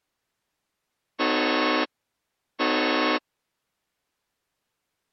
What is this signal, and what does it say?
Train horn signal, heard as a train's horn. 2 short. On North American railways: a signal is acknowledged.